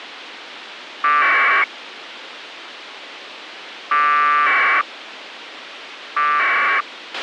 Packet radio (AX.25, as in APRS), 1200 baud, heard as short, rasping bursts, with radio hiss and a squelch burst at the end.